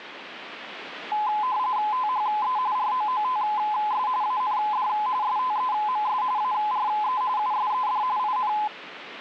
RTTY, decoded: THE ROOTS AND STEMS ARE USED IN

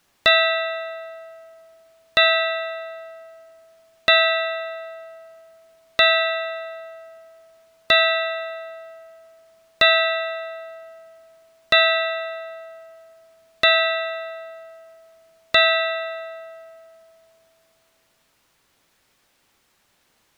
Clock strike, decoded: 9

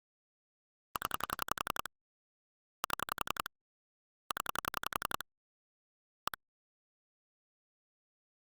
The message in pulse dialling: 0 7 0 1

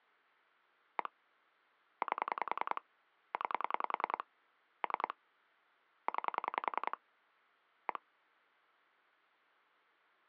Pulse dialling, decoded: 1 8 9 3 9 1

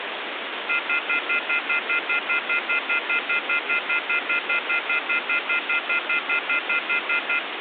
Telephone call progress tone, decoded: off-hook warning tone

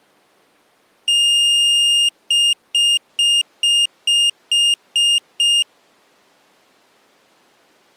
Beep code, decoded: 1 long, 8 short

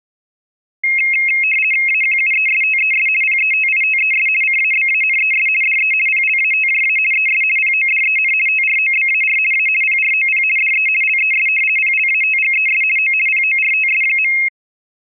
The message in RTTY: AQUESTES PETITES CABANES DE PLATJA ES PODEN TROBAR A PROP DE LES PLATGES O PORTS.

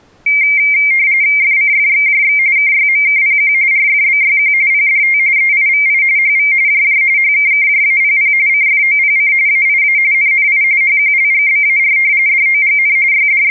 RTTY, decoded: FCFXJX KYMKPQ RFBYQ PDT EIVI HV JJ HKKJAPP CFOPC AIA NNI HQLGBAR DOGN …

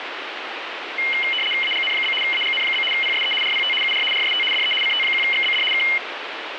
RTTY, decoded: AGN? AGN? PSE RPT UR RST DE CT1XBD K

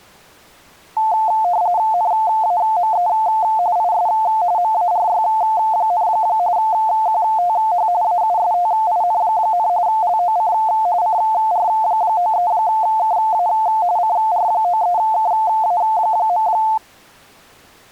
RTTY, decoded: NAME IS MARY, QTH AUSTIN, LOC CR93KA CR93KA.

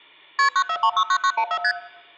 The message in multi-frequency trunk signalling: KP 94369914 ST

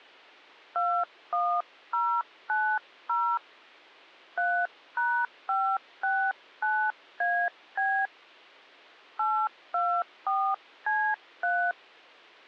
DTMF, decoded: 21090 3#569AB 824C3

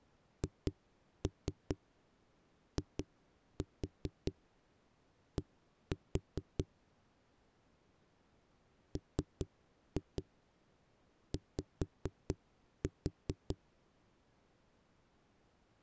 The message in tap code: HID MY

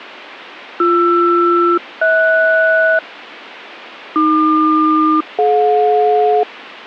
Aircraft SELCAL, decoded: BR-HS AQ-DJ

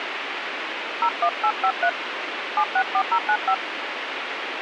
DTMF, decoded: 01853 764095

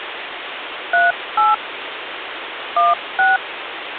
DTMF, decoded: 38 16

